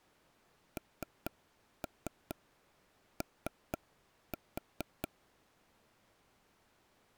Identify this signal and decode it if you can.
Tap code, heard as taps on a table, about 4 knocks a second. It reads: NO